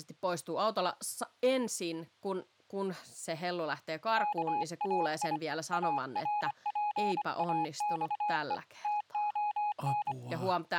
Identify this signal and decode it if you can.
Morse code (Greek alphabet), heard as a keyed tone, hand-sent with a paddle, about 25 wpm, 840 Hz, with speech in Finnish. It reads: ΚΑΙ ΑΡΠΑΞΕ ΤΟΝ